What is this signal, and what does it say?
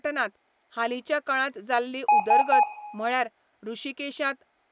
Beep code, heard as beeps from a small speaker, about 840 Hz, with room echo and speech in Goan Konkani. 3 short. In AMI BIOS tables: failure in the first 64 KB of memory; in Dell tables: chipset error.